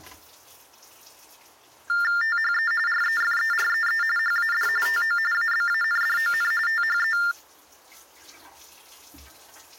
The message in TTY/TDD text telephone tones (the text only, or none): THE REFEREE HAD TO ABANDON THE